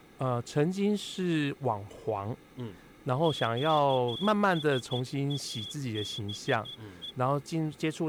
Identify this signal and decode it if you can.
Morse code, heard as a whistle, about 13 wpm, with speech in Chinese. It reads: QSABE